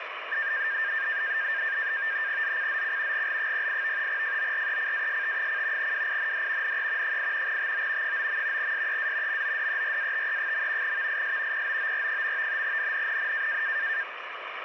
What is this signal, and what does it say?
NAVTEX (SITOR-B), 100 baud, 170 Hz shift, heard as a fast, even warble, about 1700 Hz centre, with radio static. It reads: ZCZC GL08 FORECAST: WIND NE 8 TO 9. SEA MODERATE. VIS POOR. NNNN